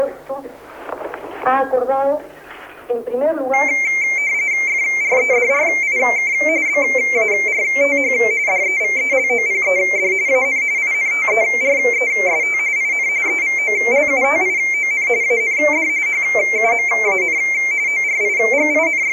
RTTY (45.45 baud, 170 Hz shift), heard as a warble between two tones, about 2200 Hz centre. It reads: FREDRIK BARTH DEVELOPED AN INTEREST IN EVOLUTION AND HUMAN …